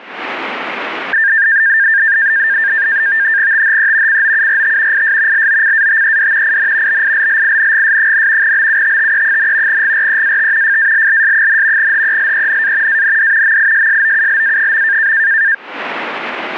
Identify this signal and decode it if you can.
NAVTEX (SITOR-B), 100 baud, 170 Hz shift, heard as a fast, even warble, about 1700 Hz centre. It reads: THE COURT IS LOCATED IN BILLINGS, BUTTE, GREAT FALLS, HELENA AND MISSOULA.